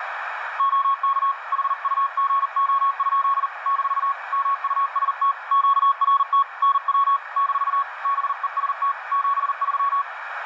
Morse code, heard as a keyed tone, hand-sent with a paddle, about 40 wpm, 1110 Hz, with radio static and a narrow filter. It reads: OK HUGO? - MUST QRT NW - BEST 73